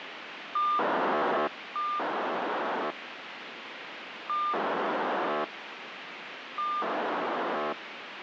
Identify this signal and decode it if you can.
POCSAG pager data (2400 baud), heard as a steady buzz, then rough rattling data, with radio hiss.